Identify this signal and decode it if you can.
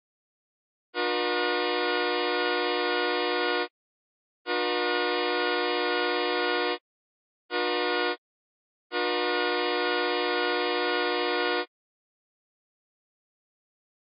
Train horn signal, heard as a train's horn. 2 long, 1 short, 1 long. On North American railways: approaching a public crossing.